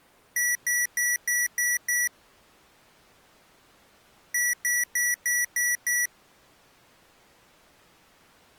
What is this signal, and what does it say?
Beep code, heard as beeps from a small speaker, played twice, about 1950 Hz. 6 short. In AMI BIOS tables: keyboard controller gate A20 failure; in Dell tables: video card failure.